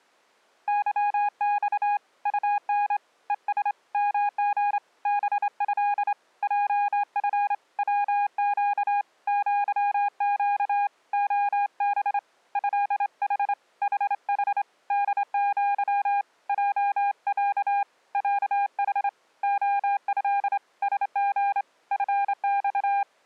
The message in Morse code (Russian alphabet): ЫЬ УН ЕС МГ БЭ ЙФ ВЩ ЪЩ ОБ ЭХ ХХ ДЪ ЙЯ ЯХ ОЭ СГ ФЬ

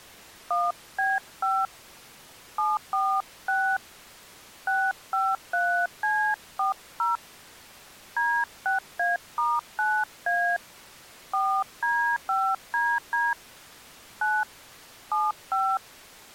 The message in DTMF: 1B5 746 653C40 D6A*9A 4D5DD 9 75

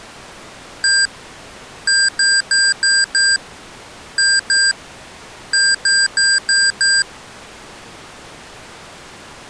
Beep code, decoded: 1-5-2-5

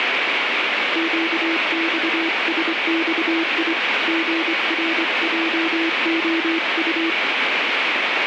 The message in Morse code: QXSXI GRJOU

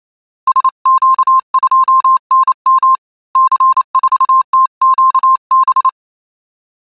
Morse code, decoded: SQ2NM C4TQB

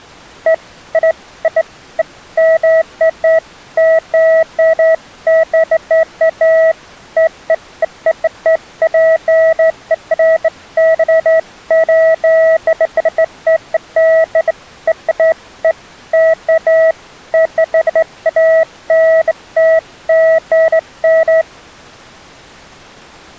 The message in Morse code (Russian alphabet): none

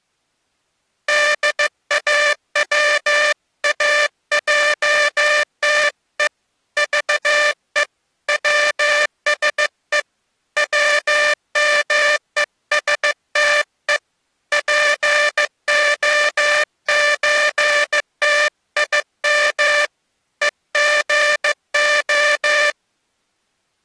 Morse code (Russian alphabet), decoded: ДАВАЙТЕ ЖЕ ВСЕ ВМЕСТЕ ПОЧТИМ ЕГО

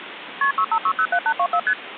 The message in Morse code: none

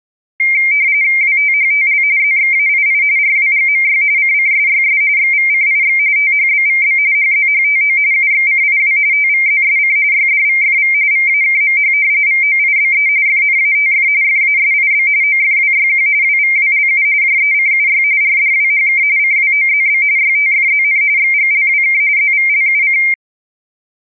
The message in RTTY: WTHTL ZXAII RWGMY CCSYS XVCIX THBVB HZHTO UXCIW TVZSC YDVFV VAKMH VOIBE FNATF FASIB OFWYQ WVWLU JECUY RDWHK CWOZB YTFZN XGLWK ZVLUC

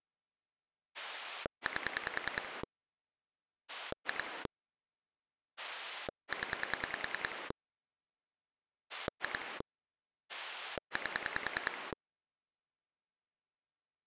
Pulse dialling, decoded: 8 2 0 2 8

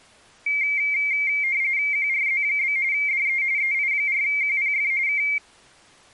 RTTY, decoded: QRZ? DE EI4QPF K

